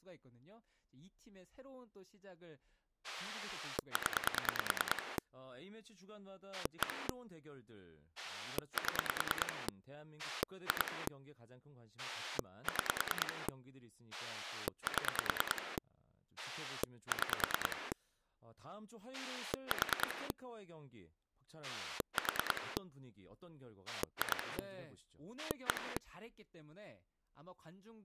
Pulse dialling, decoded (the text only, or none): 0 1 7 2 6 7 6 4 4 2 1